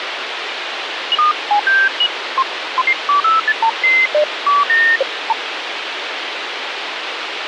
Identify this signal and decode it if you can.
Electronic bleeps of random pitch and length, with radio hiss. There is no code.